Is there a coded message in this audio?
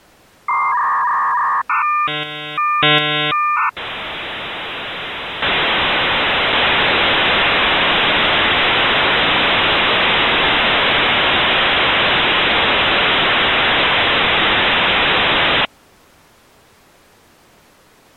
Yes: dial-up modem handshake (V.34 or later) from 0.5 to 15.7 s, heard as a whistle, warbles, then hiss.